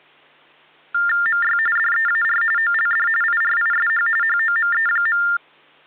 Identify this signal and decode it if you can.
TTY/TDD text telephone tones (45.45 baud Baudot), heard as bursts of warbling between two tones, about 400 Hz shift, 1600 Hz centre. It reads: MY DEAR OLD IRISH HOME.